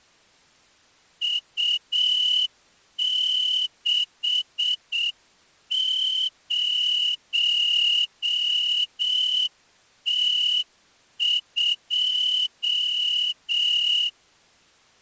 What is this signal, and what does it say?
Morse code, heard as a whistle, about 7 wpm. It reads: U60T2